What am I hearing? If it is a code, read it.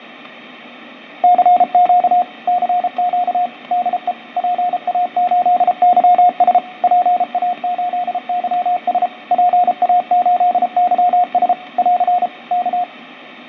Morse code, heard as a keyed tone, machine-sent, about 33 wpm, 720 Hz, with radio static, fading and static crashes. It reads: CQ CQ DE PA8YS PA8YS PA8YS <AR> K